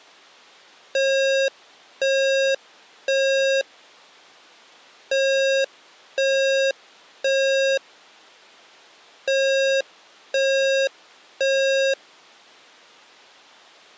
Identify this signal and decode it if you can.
Alarm pattern, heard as an alarm's beeps, played three times, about 540 Hz. Temporal three. Smoke or fire, evacuate.